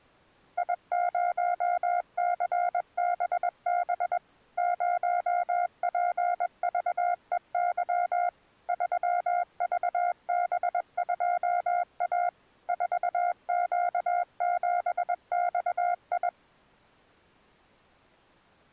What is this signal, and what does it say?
Morse code, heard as a keyed tone, machine-sent, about 21 wpm, 710 Hz. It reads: I0CBB 0PVEY 3VB2A 4Q7XI